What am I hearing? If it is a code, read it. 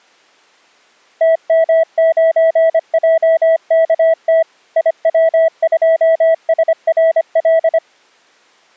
Morse code, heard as a keyed tone, machine-sent, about 25 wpm, 650 Hz. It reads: TM9JKT IW2SRL